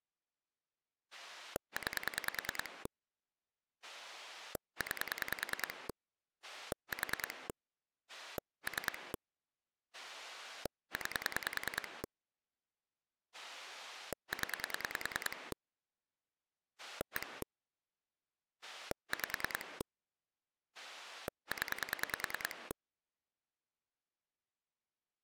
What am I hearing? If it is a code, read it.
Pulse dialling, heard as a rotary dial, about 10 pulses a second. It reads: 9 9 4 3 9 0 1 5 0